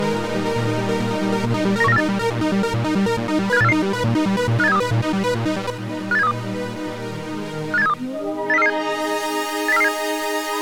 Five-tone selective call (EEA), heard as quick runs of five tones, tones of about 40 ms. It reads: 91948 75844 58732 58732 58732 80447 80447